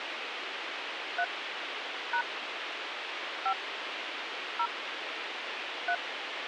DTMF, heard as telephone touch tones, dialled by hand, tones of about 70 ms, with radio hiss and a squelch burst at the end. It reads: 3 # 5 0 3